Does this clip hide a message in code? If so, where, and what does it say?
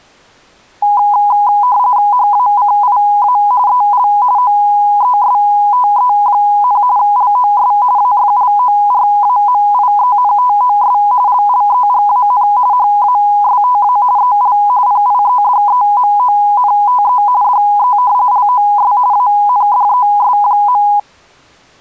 Yes: RTTY (45.45 baud, 170 Hz shift) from 0.8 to 21.0 s, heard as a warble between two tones, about 910 Hz centre. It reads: HACIA EL OESTE, LOS AFLORAMIENTOS LLEGAN HASTA EL PIEDEMONTE DE LOS ANDES.